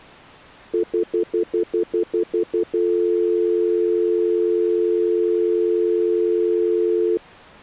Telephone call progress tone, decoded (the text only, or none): stutter dial tone